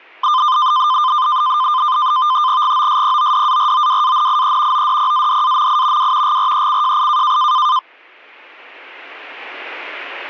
NAVTEX (SITOR-B), 100 baud, 170 Hz shift, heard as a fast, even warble, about 1120 Hz centre, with static crashes. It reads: GOSPODAROWANIE ODPADAMI W GRECJI